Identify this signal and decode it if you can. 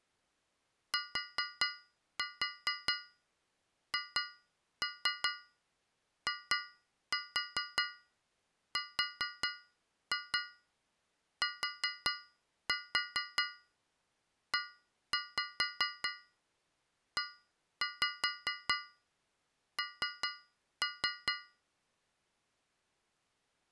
Tap code, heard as taps on a metal pipe, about 4 knocks a second. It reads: THIRTEEN